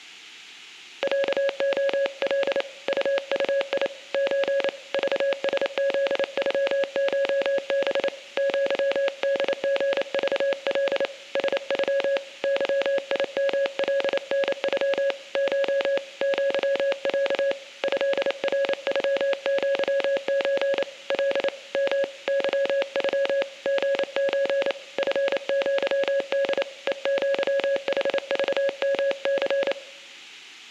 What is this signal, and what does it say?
Morse code (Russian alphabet), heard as a keyed tone, hand-sent with a paddle, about 28 wpm, 550 Hz, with room echo. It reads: ЯОЛ УУИ Ч ЖСЗЮШБ ЪДГЖЛ СЮ ЫИМЛНЮ Ш ЪЯ ЭРЮЪЧ Л М ЫЮ ГЧ ФЪД ЕЪХЖМЦ